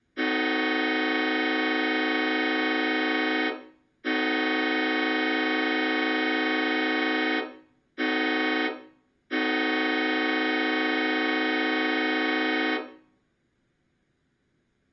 Train horn signal, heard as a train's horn, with room echo. 2 long, 1 short, 1 long. On North American railways: approaching a public crossing.